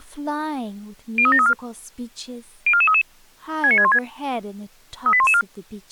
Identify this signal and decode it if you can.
Five-tone selective call (ZVEI), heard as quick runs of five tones, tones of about 70 ms, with speech in English. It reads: 03734 04433 69616 38114